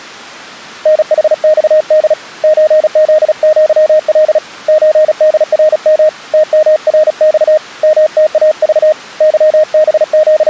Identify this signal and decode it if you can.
Morse code (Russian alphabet), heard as a keyed tone, hand-sent with a paddle, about 36 wpm, 620 Hz. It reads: НХЬД ЧЗЪЛ ЧДРМ ТМРЬ МТАЖ …